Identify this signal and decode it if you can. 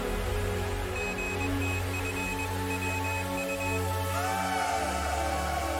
Morse code (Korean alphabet), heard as a high beeper, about 21 wpm, 2550 Hz. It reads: 선비